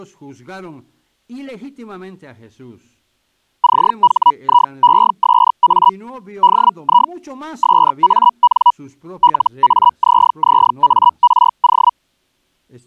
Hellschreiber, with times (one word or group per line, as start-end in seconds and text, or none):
3.6-5.9 CHIESA
6.4-7.1 DI
7.6-8.7 SAN
9.2-11.9 LAZZARO